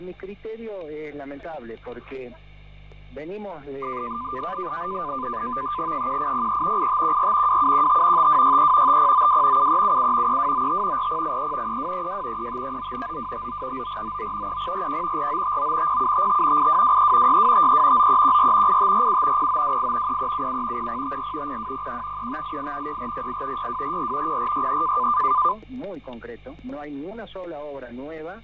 NAVTEX (SITOR-B), 100 baud, 170 Hz shift, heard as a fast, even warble, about 1110 Hz centre, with fading and static crashes. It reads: 1803 8514 2715 5263 5092 7377 3295 4083 3232 3539 9259 9499 3041 4959 0755 8223 6253 9314 8547 0928 3377 0054 0201 3588 6408 6244 0463